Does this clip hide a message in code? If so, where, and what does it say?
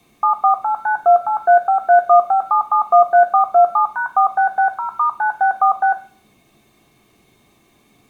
Yes: DTMF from 0.2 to 5.9 s, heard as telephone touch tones, dialled by machine, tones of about 100 ms. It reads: 748928353157713427#4660*9646